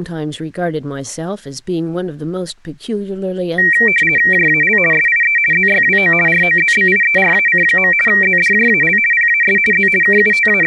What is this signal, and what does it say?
RTTY (50 baud, 450 Hz shift), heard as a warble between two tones, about 2100 Hz centre, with speech in English. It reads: JAL SIE ZYWO ROZBIERAC. ZDJAL PAS Z …